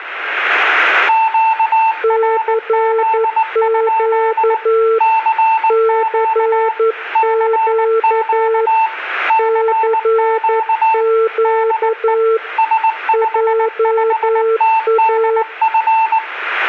Morse code, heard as two keyed tones, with room echo. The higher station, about 19 wpm, 890 Hz: QRZ? CQ CQ CQ DE S55TDF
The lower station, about 11 wpm, 450 Hz: CQ CQ CQ JA